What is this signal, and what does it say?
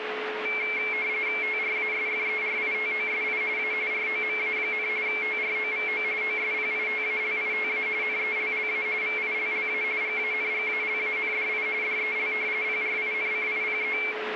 RTTY (45.45 baud, 170 Hz shift), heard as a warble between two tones, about 2250 Hz centre, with radio static and a steady whistle near 430 Hz. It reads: TRASFERITOSI A ROMA, TROVO OSPITALITA NELLA VILLA GANGALANDI DEL PRINCIPE